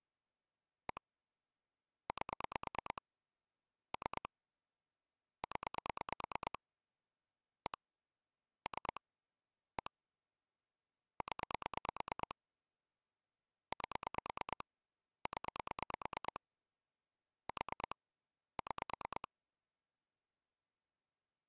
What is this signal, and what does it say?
Pulse dialling, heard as clicks on a phone line, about 9 pulses a second. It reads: 1 8 3 0 1 3 1 0 8 0 4 6